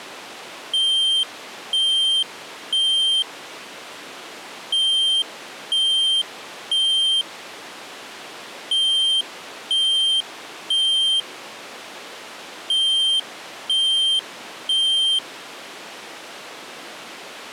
Alarm pattern, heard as an alarm's beeps, played four times, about 3150 Hz. Temporal three. Smoke or fire, evacuate.